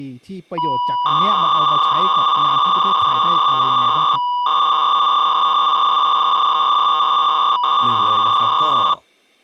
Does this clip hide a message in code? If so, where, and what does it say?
Yes: 300-baud modem data (V.21 tones) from 0.6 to 8.9 s, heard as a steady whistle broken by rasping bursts, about 300 baud, 200 Hz shift, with speech in Thai.